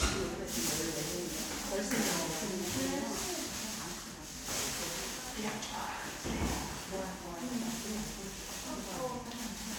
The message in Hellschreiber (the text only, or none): none